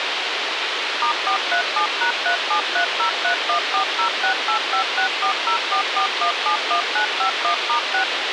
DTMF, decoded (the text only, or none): *437#3730314068564044171951*6